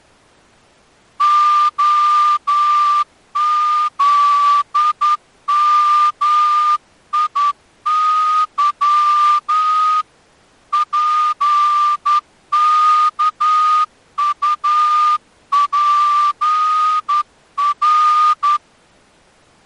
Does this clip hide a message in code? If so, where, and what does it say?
Yes: Morse code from 1.1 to 18.6 s, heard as a whistle, hand-sent with a straight key, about 10 wpm. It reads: OZMIY PKUPR